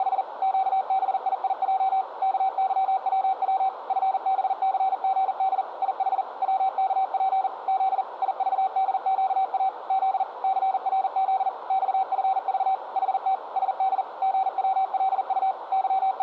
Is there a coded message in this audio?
Yes: Morse code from 0.0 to 16.2 s, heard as a keyed tone, machine-sent, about 40 wpm, 770 Hz, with radio static and a narrow filter. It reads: … QBIIJ KYWW FBCGD IH WKP Z IVDQA Z CRZ XFV HT SD GWLU …